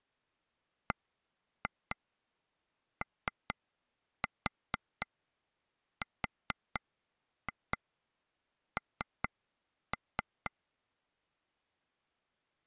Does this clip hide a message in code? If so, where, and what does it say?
Yes: tap code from 0.9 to 10.5 s, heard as taps on a table, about 4 knocks a second. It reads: BORN